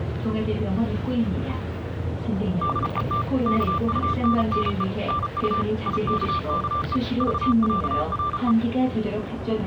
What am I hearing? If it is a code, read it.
Morse code (with Danish letters), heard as a keyed tone, machine-sent, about 34 wpm, 1180 Hz, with the noise inside a bus. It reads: DET KUNNE NU IKKE VÆRE